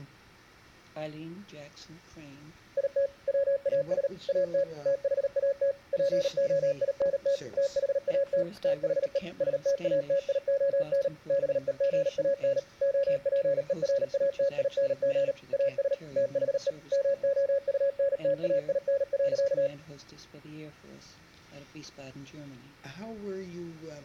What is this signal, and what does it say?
Morse code, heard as a keyed tone, machine-sent, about 38 wpm, 560 Hz. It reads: IT WAS AT THAT POINT THAT THE STATION BEGAN OPERATING AS THE MOUNTAIN.